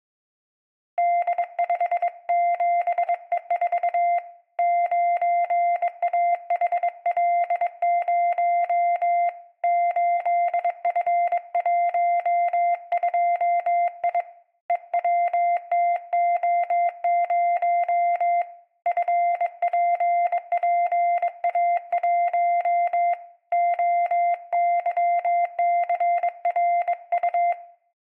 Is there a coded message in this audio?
Yes: Morse code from 0.9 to 27.6 s, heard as a keyed tone, hand-sent with a bug key, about 22 wpm, 700 Hz, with room echo. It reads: D57E4 9AHL0 8F12I EWTO0 FPPA1 OYCRU